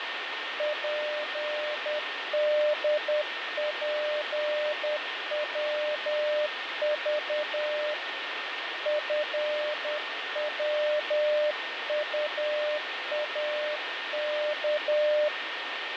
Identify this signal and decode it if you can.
Morse code, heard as a keyed tone, hand-sent with a paddle, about 10 wpm, 600 Hz, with radio static, fading and a steady whistle near 1830 Hz. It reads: PDPWV FWUAK